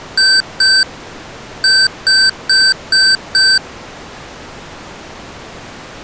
Beep code, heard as beeps from a small speaker, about 1550 Hz. 2-5.